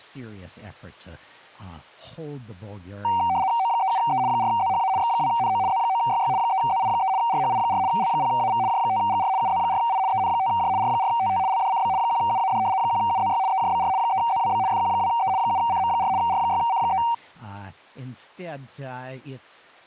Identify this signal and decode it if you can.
RTTY (75 baud, 170 Hz shift), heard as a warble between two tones, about 850 Hz centre, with speech in English. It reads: O37E 4ZHA X2NO Z9YY 3ZI3 RHI4 L0AV J5GR UZ4I EN5J R4TT LDCB 1UAD 1UZY EJBR 3ZWB FQ2E 7CM4 R6C3